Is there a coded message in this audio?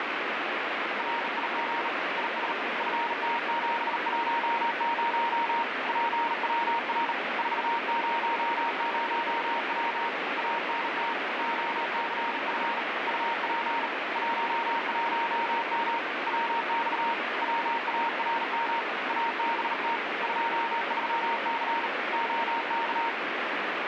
Yes: Morse code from 0.9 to 23.2 s, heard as a keyed tone, hand-sent with a bug key, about 38 wpm, 930 Hz, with heavy radio static. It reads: RIG IS FT710 PWR 400W ANT OCF UP 11M WX WARM ABT 23C OK